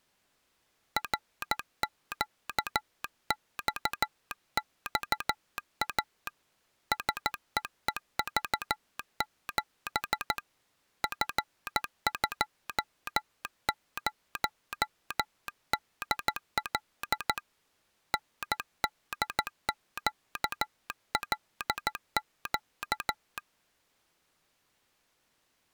Morse code, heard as a telegraph sounder, hand-sent with a paddle, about 14 wpm. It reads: RQXXA SEEV7 F20DL NDQLQ